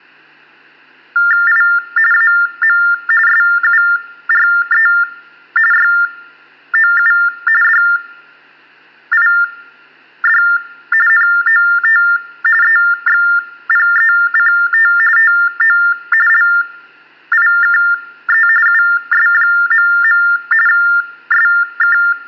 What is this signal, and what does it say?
TTY/TDD text telephone tones (45.45 baud Baudot), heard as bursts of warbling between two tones, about 400 Hz shift, 1600 Hz centre, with hum. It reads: I AM SURE YOU DID NOT EXPECT TO LIKE US.. SK